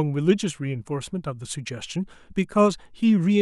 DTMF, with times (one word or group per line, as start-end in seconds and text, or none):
none